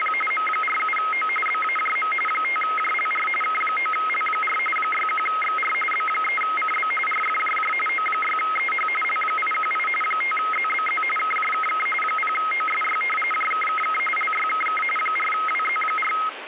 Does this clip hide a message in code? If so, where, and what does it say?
Yes: RTTY (45.45 baud, 850 Hz shift) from 0.0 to 16.3 s, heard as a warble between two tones, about 1700 Hz centre, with radio static. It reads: … M47O BAJM 5JLR K9L4 61XR B3CB RFJJ O6EH L818 5ZBZ KJKK 0OSY JKKK LYKK 4WZ4